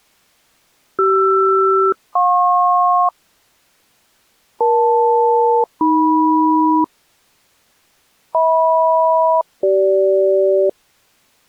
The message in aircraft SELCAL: CR-JP EL-AM HM-CG

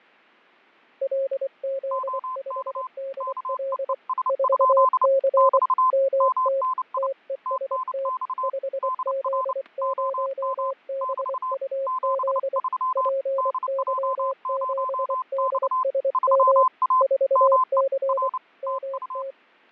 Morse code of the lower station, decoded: LZ5DL 4C MT TEST 5Z0BUZ PY7DSM 4C MT

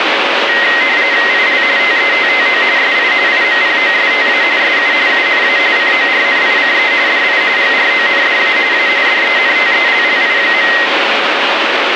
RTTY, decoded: IL TETTO SI IMPOSTA SU UNA CORNICE DI GRONDA A DENTELLI.

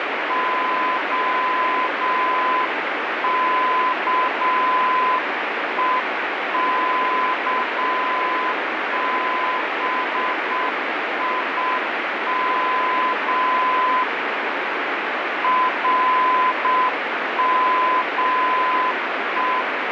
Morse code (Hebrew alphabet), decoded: הכוכבים רמו

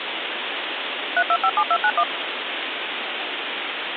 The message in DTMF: 3257291

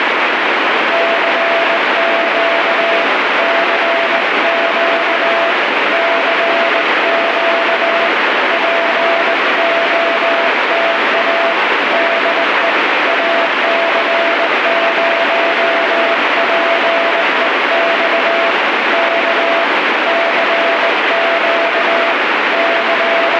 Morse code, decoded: CQ CQ CQ POTA DE AC0PEX K CQ …

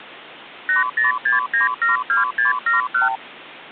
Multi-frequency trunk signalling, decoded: 806972671

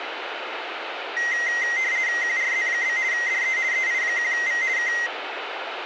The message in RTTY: QRZ? DE EI1V K

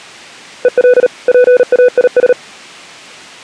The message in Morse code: EL PAIS

